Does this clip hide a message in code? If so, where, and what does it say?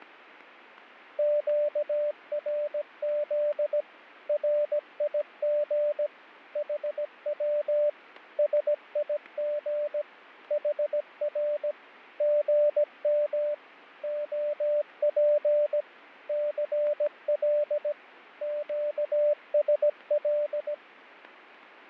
Yes: Morse code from 1.1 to 20.8 s, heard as a keyed tone, machine-sent, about 17 wpm, 590 Hz, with fading and static crashes. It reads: QRZ RIG HW SIG HR GM OP CL QSL